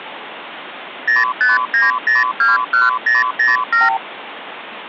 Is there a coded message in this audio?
Yes: multi-frequency trunk signalling (R2, with the far end's replies) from 1.1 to 4.0 s, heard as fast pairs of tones, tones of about 170 ms, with phone line noise. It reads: 059021007